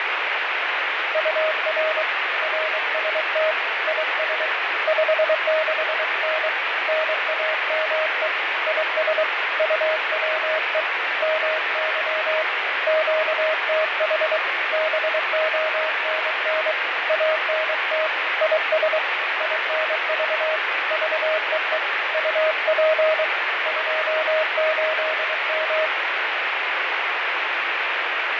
Morse code, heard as a keyed tone, hand-sent with a paddle, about 23 wpm, 630 Hz, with heavy radio static and fading. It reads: UR RST IS 56N NAME IS UWE MY QTH BONN ANT IS INV VEE UP 28M